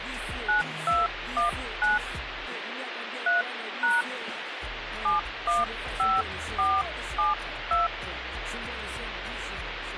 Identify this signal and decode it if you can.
DTMF, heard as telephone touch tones, dialled by hand, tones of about 180 ms, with phone line noise. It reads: 9219 3# 715472